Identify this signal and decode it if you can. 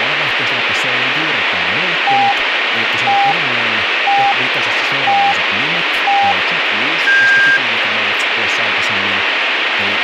Radio time signal (five pips and a higher one, as on Chinese radio), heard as pips, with radio static and speech in Finnish.